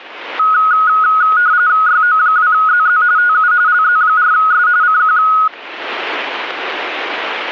RTTY (45.45 baud, 170 Hz shift), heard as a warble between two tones, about 1360 Hz centre. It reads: YO2ZZ TU LZ4S CQ